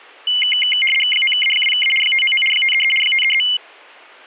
RTTY (75 baud, 850 Hz shift), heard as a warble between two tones, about 2550 Hz centre. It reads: 9A2A 599 533 533